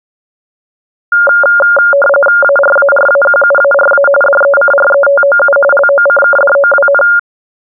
RTTY (45.45 baud, 850 Hz shift), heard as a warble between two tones, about 990 Hz centre. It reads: ARARAQUARA DECRETOU LOCKDOWN